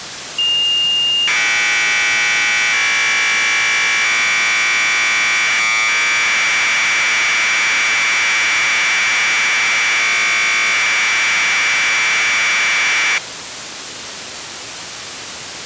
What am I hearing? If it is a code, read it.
Commodore tape loading (standard loader), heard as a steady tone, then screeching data, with tape hiss.